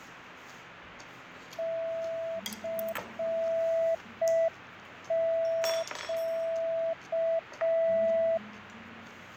Morse code, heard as a keyed tone, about 5 wpm, 660 Hz, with radio static, fading and the noise of a restaurant. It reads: CQ